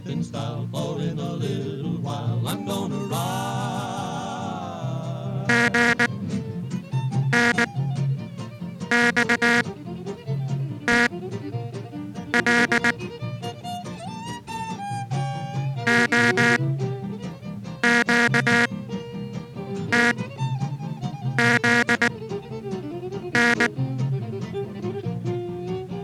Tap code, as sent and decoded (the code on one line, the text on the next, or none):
none